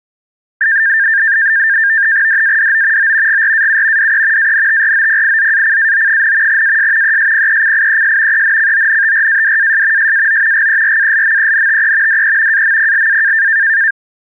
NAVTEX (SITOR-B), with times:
2.3-3.1 DADO
3.0-3.4 O
3.3-4.1 GRAU
4.0-4.5 DE
4.4-6.6 ANTROPIZACAO,
6.5-7.2 AS
7.0-8.4 ESPECIES
8.3-10.1 ENCONTRADAS
10.0-10.7 SAO
10.5-12.2 GERALMENTE
12.1-12.6 DE
12.5-13.5 AMPLA

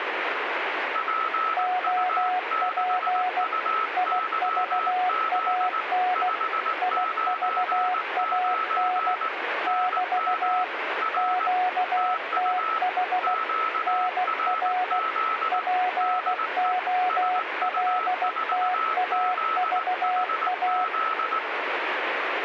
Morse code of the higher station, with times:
1.0-5.8 PU6UYZ
6.2-9.3 599
9.7-10.6 NM
11.0-11.5 R
12.0-12.8 TU
13.2-15.6 QRZ
16.0-16.7 DE
17.1-21.4 SU4ZHZ

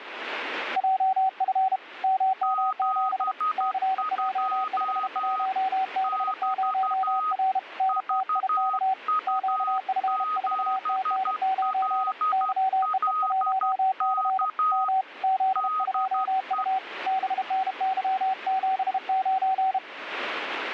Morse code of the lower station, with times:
0.8-1.8 JF
2.0-3.3 MM7
3.6-7.6 CJ51B0R
7.8-8.9 NTIK
9.3-12.1 QF4TN9
12.3-14.5 YEE1C
14.7-15.0 M
15.2-16.8 Z2U
17.1-19.8 BNY79

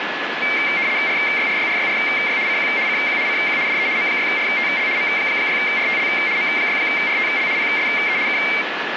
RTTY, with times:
1.1-2.4 RYRYRYRY
2.5-2.7 CQ
2.9-3.2 CQ
3.3-3.6 CQ
3.7-3.9 DE
4.0-4.9 M6RTL
5.0-6.1 M6RTL
6.4-7.5 M6RTL
7.6-8.2 PSE
8.3-8.4 K

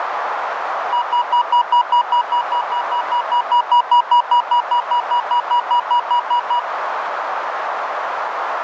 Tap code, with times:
none

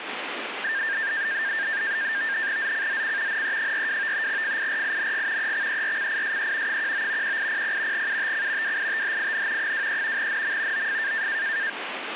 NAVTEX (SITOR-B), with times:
2.6-3.4 ZCZC
3.3-4.3 NE42
4.3-5.5 FIRING
5.4-6.8 EXERCISE
6.7-7.4 19
7.2-8.1 1800
7.9-8.8 UTC
8.6-9.7 WITHIN
9.6-10.3 23
10.2-10.9 NM
10.7-11.3 OF

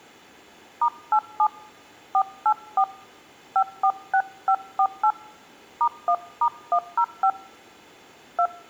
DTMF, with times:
0.8-1.5 *87
2.1-2.8 484
3.6-5.1 546548
5.8-7.3 *1*105
8.4-8.5 2

